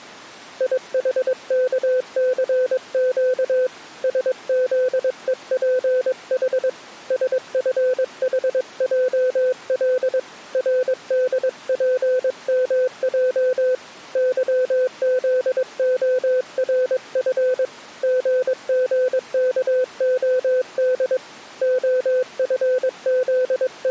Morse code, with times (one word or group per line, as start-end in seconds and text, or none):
0.6-3.7 IHKCQ
4.0-6.7 SZEPH
7.1-10.2 SFHJL
10.5-13.7 RDPMJ
14.2-17.6 YZORF
18.0-21.2 GGKOD
21.6-23.9 …